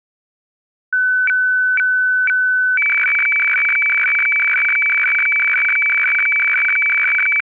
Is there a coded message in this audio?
Yes: weather fax (radiofax), 120 lines a minute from 0.9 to 7.4 s, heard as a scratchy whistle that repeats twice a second.